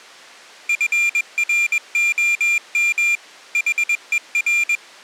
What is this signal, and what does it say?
Morse code, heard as a high beeper, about 21 wpm, 2400 Hz. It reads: FROM HER